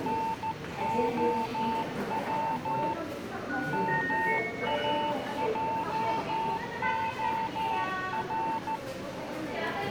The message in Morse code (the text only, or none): NOW MAJOR